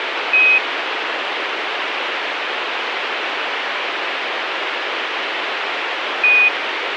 Quindar tones, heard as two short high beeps, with radio hiss.